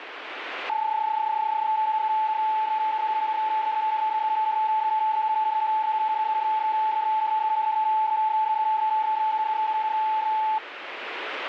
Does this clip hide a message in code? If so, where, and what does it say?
Yes: PSK31 (31.25 baud) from 0.7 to 10.6 s, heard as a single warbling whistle, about 870 Hz, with radio static.